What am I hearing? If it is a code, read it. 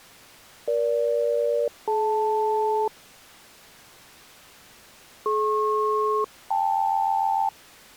Aircraft SELCAL, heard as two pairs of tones. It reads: EG-DL DP-KL